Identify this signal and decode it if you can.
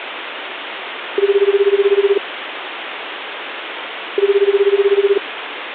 Telephone call progress tone (Japanese plan), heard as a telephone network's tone, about 380, 400, 420 Hz, 1 s on and 2 s off, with phone line noise. Ringback tone.